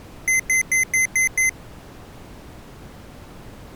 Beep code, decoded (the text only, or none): 6 short